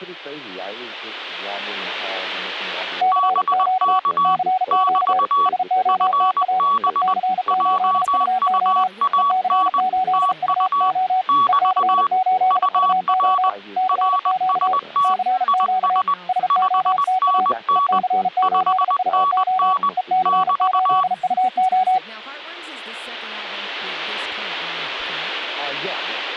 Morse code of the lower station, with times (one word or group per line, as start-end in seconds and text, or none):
3.0-4.0 CQ
4.2-5.2 CQ
5.5-6.6 SOTA
6.9-8.9 EC8UO
9.2-11.2 EC8UO
11.5-13.5 EC8UO
13.8-14.7 CQ
15.0-16.0 CQ
16.3-17.5 SOTA
17.8-19.7 EC8UO
20.0-22.0 EC8UO